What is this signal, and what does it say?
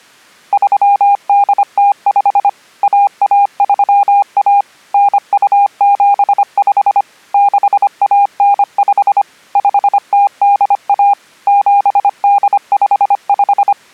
Morse code (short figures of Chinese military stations), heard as a keyed tone, machine-sent, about 25 wpm, 810 Hz. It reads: 3805 1131 9275 6195 5081 7855